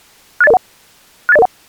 Five-tone selective call (EIA), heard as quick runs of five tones, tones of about 30 ms. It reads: 68001 68001